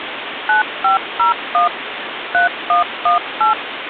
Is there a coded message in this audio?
Yes: DTMF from 0.5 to 3.5 s, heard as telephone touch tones, dialled by machine, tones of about 130 ms, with phone line noise. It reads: 9501 3118